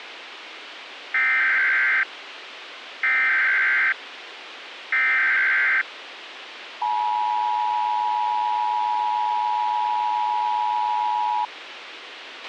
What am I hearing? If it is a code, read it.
Emergency Alert System (SAME) tones (header bursts, then the 853 and 960 Hz attention tone), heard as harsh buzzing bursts, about 520.83 baud, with radio hiss and a squelch burst at the end.